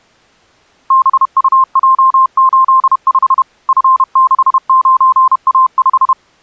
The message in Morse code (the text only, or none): BUJ85 F69A5